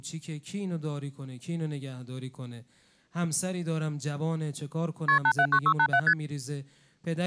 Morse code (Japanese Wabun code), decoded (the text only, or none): none